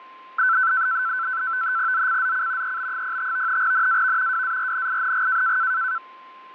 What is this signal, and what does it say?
NAVTEX (SITOR-B), 100 baud, 170 Hz shift, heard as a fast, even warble, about 1430 Hz centre, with fading and a steady whistle near 1040 Hz. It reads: ZCZC EB05 NAV WARNING